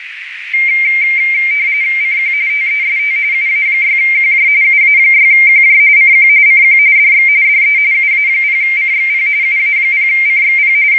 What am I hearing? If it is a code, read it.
RTTY (45.45 baud, 170 Hz shift), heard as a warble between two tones, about 2200 Hz centre, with radio static and a narrow filter. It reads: CQ TEST UA6QJ UA6QJ CQ CQ DX DE UA0CXP UA0CXP …